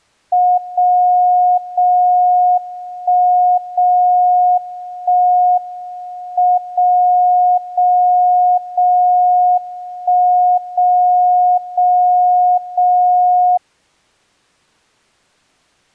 Radio time signal (WWVB), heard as a tone whose level steps once a second, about 720 Hz. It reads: 0 0 1 0 1 M 0 0 0 1 0 0 0